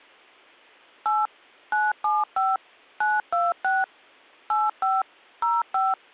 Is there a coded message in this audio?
Yes: DTMF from 1.1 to 5.9 s, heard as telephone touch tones, dialled by machine, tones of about 200 ms. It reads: 8 975 926 85 05